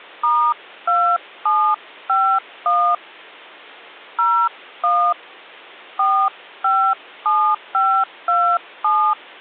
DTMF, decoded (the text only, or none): *2751 01 457527